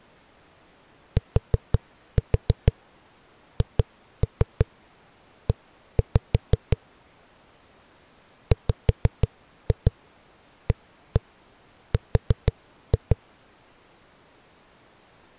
Tap code, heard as knocks on a wall, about 6 knocks a second. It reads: THE WAR